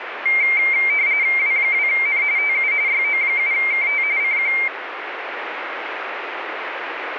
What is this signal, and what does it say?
RTTY (45.45 baud, 170 Hz shift), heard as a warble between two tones, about 2200 Hz centre, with radio static. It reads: W2N TU YO7KT CQ